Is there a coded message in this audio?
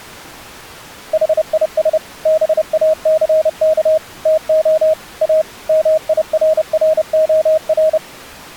Yes: Morse code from 1.1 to 8.0 s, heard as a keyed tone, machine-sent, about 30 wpm, 630 Hz. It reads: HIS BACK TO A MIRROR